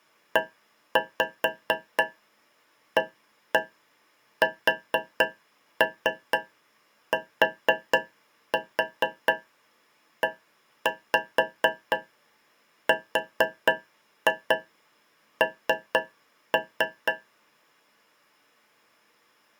Tap code, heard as taps on a metal pipe, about 4 knocks a second. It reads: EASTERN